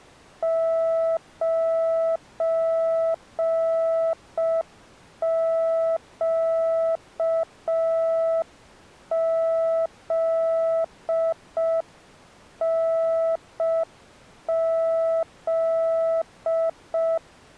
Morse code, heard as a keyed tone, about 5 wpm, 660 Hz. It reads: 9QZNZ